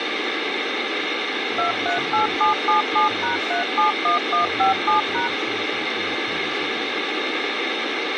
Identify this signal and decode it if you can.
DTMF, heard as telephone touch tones, dialled by machine, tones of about 130 ms, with radio hiss. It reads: 238777#371157#